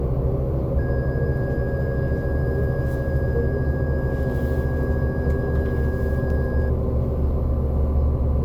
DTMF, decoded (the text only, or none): none